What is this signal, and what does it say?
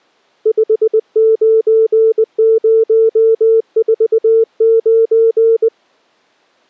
Morse code, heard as a keyed tone, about 20 wpm, 450 Hz. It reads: 59049